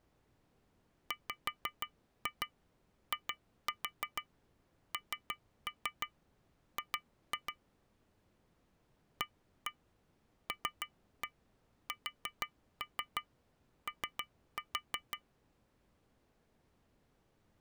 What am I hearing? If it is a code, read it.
Tap code, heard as taps on glass, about 6 knocks a second. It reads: WING ALSO